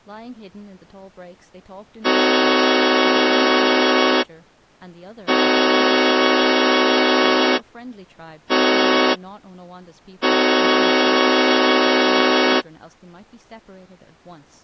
Train horn signal, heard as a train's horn, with speech in English. 2 long, 1 short, 1 long. On North American railways: approaching a public crossing.